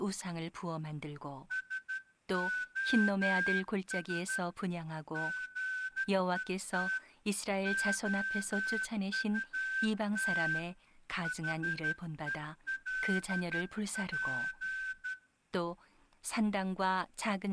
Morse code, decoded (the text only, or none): SOS GET OUT HELP